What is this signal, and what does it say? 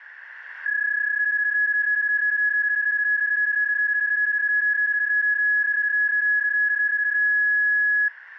PSK31 (31.25 baud), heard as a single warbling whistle, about 1700 Hz, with radio static.